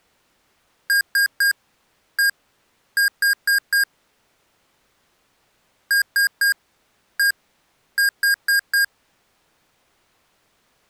Beep code, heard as beeps from a small speaker, played twice, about 1600 Hz. 3-1-4. In Phoenix BIOS tables: interrupt mask register failure.